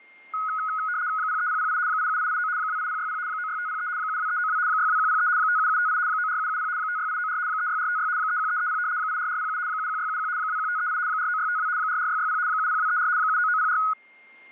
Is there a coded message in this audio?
Yes: RTTY (75 baud, 170 Hz shift) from 0.3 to 13.9 s, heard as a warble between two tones, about 1360 Hz centre, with a steady whistle near 2120 Hz. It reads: 03008 87889 28060 96503 72392 62103 57758 94770 56894 36456 31330 84407 71671 21538 49652 44660 70234 79904